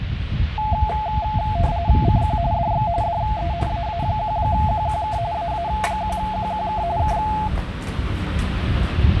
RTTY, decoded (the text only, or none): CQ DX DE AA1QQK AA1QQK K